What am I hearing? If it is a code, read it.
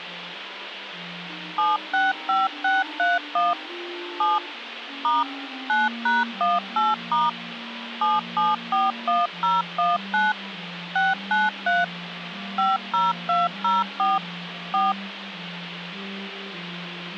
DTMF, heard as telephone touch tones, dialled by machine, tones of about 180 ms, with phone line noise. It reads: 765631 7 * 9#18* 7741019 693 50204 4